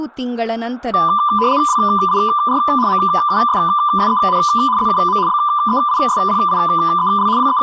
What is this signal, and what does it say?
RTTY (75 baud, 170 Hz shift), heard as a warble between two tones, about 1100 Hz centre, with room echo and speech in Kannada. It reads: WIR MUSSEN ZUM BEISPIEL …